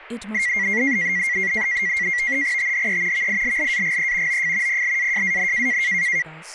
NAVTEX (SITOR-B), 100 baud, 170 Hz shift, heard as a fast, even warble, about 2050 Hz centre, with radio static and speech in English. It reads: THE VILLAGE OF PLAJAN